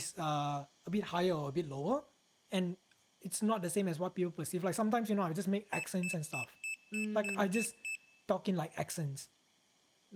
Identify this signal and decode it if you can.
Beep code, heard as a piezo beeper, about 2650 Hz, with speech in English. 8 short. In AMI BIOS tables: display memory failure; in Dell tables: LCD failure.